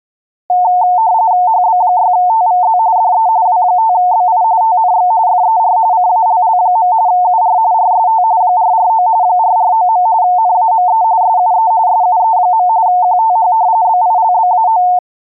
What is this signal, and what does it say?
RTTY (45.45 baud, 170 Hz shift), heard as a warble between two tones, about 810 Hz centre. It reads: HB6TVZ DE W5BI TNX FER CALL. UR RST 449 449. NAME SUE SUE. QTH BILBAO